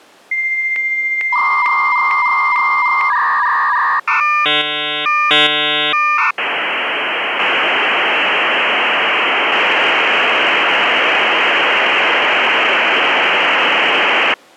Dial-up modem handshake (V.34 or later), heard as a whistle, warbles, then hiss.